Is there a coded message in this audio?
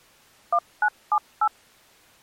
Yes: DTMF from 0.5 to 1.5 s, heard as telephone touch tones, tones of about 60 ms. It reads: 1978